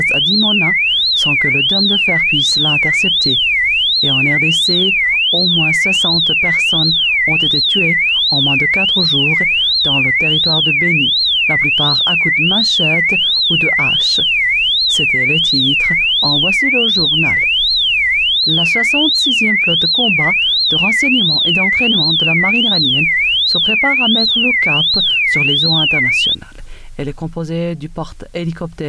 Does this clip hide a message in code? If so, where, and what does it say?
No, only a tone that sweeps in pitch again and again.